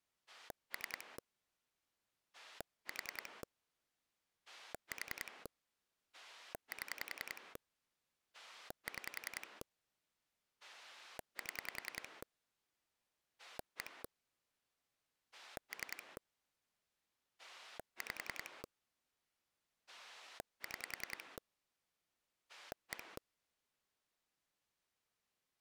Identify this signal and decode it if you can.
Pulse dialling, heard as a rotary dial, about 10 pulses a second. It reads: 3 4 4 7 6 7 1 3 5 6 1